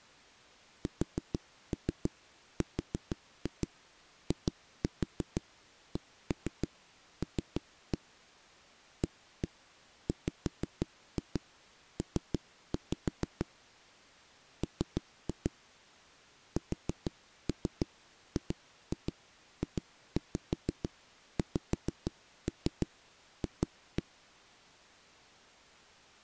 Tap code, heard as knocks on a wall, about 6 knocks a second. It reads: SRICL AWP M SGJXF